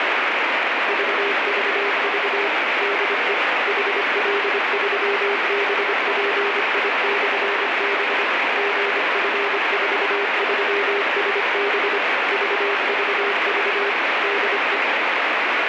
Morse code, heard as a keyed tone, machine-sent, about 25 wpm, 400 Hz, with heavy radio static. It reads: VVV DE HL3BPI/B GF43SB VVV DE